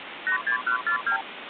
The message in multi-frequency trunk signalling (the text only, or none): 86142